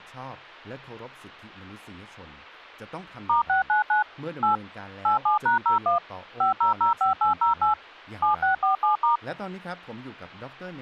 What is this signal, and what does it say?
DTMF, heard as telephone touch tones, dialled by machine, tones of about 130 ms, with speech in Thai. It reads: *699 8 87#01 5005808 7647*